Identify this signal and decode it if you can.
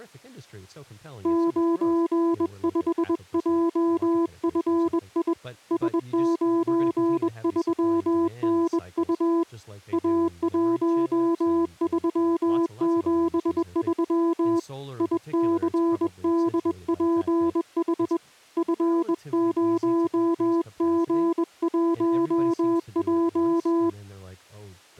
Morse code, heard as a keyed tone, hand-sent with a bug key, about 21 wpm, 340 Hz, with speech in English. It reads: 95JFI S93NU A1373 ICDPH F0G1J